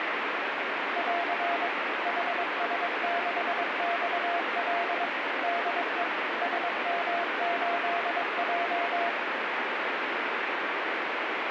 Morse code, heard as a keyed tone, machine-sent, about 22 wpm, 690 Hz, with heavy radio static. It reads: <AR> HS6XL DE SM8J